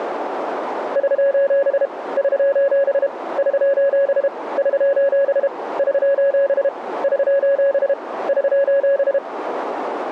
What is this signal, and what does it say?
Morse code, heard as a keyed tone, hand-sent with a paddle, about 32 wpm, 560 Hz, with radio static. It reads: <SOS> <SOS> <SOS> <SOS> <SOS> <SOS> <SOS>